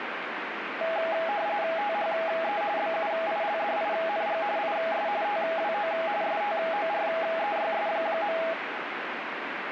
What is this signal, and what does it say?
RTTY (45.45 baud, 170 Hz shift), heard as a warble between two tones, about 740 Hz centre, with radio static. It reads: THE BUILDING IS TWO STOREYS.